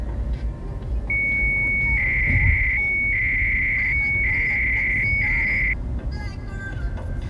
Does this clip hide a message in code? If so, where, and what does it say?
Yes: 300-baud modem data (Bell 103 tones) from 1.1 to 5.7 s, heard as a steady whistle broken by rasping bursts, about 300 baud, 200 Hz shift, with the noise inside a car.